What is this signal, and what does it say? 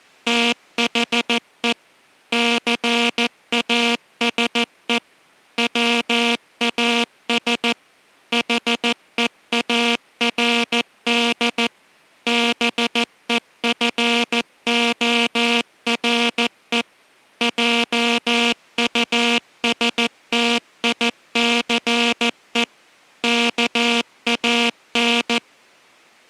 Morse code, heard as a buzzer, machine-sent, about 14 wpm. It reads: THE CASE WAS HEARD BEFORE JUSTICE KAN